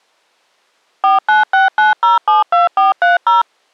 DTMF, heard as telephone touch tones, dialled by machine, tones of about 150 ms. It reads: 4969072430